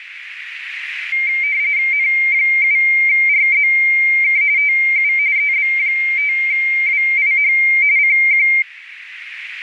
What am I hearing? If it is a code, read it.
RTTY (45.45 baud, 170 Hz shift), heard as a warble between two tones, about 2200 Hz centre, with radio static and a narrow filter. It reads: N7RZK TU EB5WIH CQ